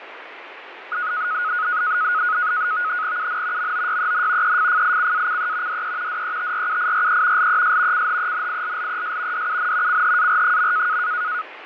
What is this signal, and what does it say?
NAVTEX (SITOR-B), 100 baud, 170 Hz shift, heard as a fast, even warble, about 1360 Hz centre, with radio static and fading. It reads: UN MOYEN EFFICACE DE DETRUIRE LES CHENILLES DUN CHAR.